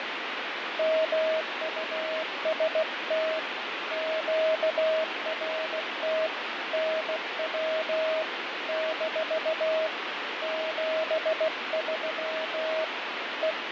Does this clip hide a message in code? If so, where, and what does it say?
Yes: Morse code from 0.7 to 13.7 s, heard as a keyed tone, hand-sent with a bug key, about 16 wpm, 640 Hz, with heavy radio static and fading. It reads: MUST QRT NW - 73 …